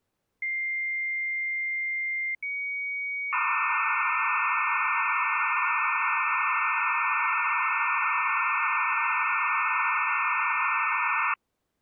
Dial-up modem handshake (low-speed, two carriers), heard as two whistles, then hiss.